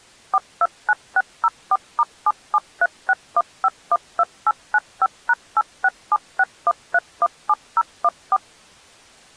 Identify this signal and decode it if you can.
DTMF, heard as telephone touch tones, dialled by machine, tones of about 40 ms. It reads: 429604*77361512895#86761317014